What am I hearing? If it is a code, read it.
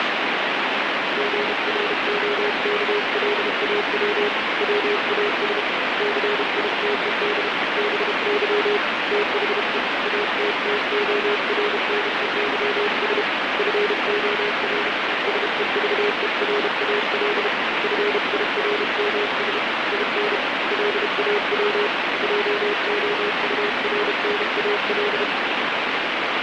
Morse code, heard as a keyed tone, hand-sent with a paddle, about 32 wpm, 410 Hz, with heavy radio static. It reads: GROKLAW WAS CITED BY THE ATTORNEYS FOR SEVERAL FIRMS IN LAW JOURNAL